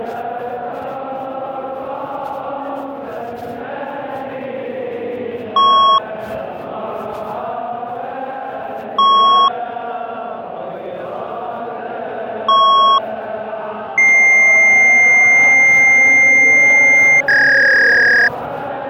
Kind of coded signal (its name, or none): fax machine handshake